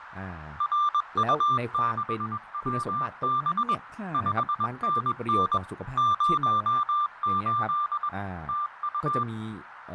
Morse code, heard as a keyed tone, machine-sent, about 21 wpm, 1180 Hz, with radio static, fading, a narrow filter and speech in Thai. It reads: RU6WB 5NN 08 TU